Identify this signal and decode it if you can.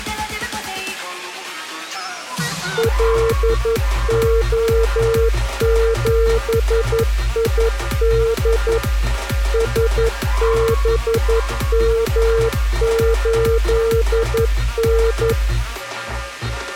Morse code, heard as a keyed tone, machine-sent, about 11 wpm, 460 Hz. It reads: LO7ID SBM8N